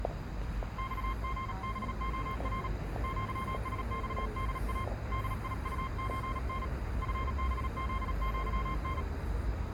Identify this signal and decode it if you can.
Morse code (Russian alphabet), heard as a keyed tone, hand-sent with a paddle, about 37 wpm, 1060 Hz, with the noise of a residential street. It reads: ЬГБОР ЪСЬДА ДИУЧН ФБЗЪН